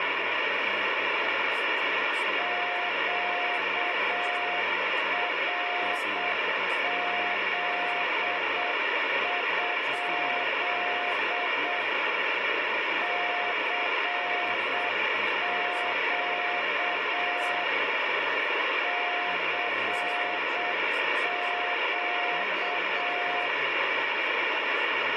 Morse code, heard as a keyed tone, machine-sent, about 7 wpm, 710 Hz, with heavy radio static and speech in English. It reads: QRZ? CQ CQ